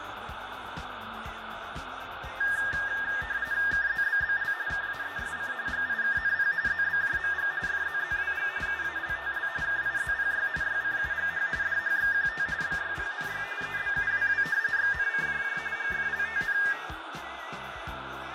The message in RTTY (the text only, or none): KZBBL KAESC GIKNP ZBJMG FZZWG UALTL KIZPY YCUGH DHXQT BYPNY EBUWW XNCJJ GFLTN